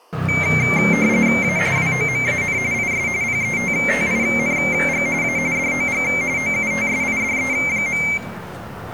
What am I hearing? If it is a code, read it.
RTTY (45.45 baud, 170 Hz shift), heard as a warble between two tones, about 2200 Hz centre, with the noise of a residential street. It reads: A WOMAN IS PETTING A DOG OUTSIDE.